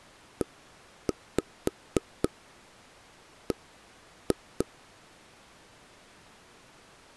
Tap code, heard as knocks on wood, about 3 knocks a second. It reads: EB